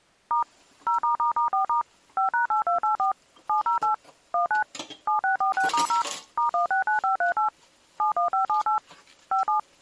DTMF, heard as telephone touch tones, dialled by machine, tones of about 120 ms, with kitchen noise. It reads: * 0***4* 5#8284 708 19 7646*0 *169538 71578 57